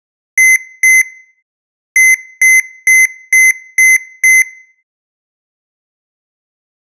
Beep code, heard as beeps from a small speaker, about 2050 Hz, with room echo. 2-6.